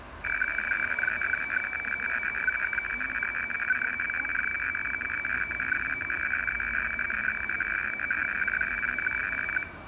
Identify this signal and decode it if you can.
Weather fax (radiofax), 120 lines a minute, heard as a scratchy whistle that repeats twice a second, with room echo and street noise.